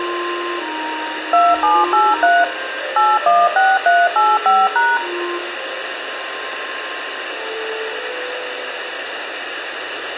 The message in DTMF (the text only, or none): 2783 816385#